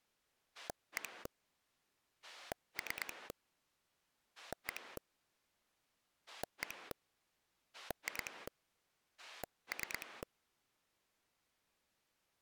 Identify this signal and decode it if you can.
Pulse dialling, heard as a rotary dial, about 9 pulses a second. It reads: 1 3 1 1 2 3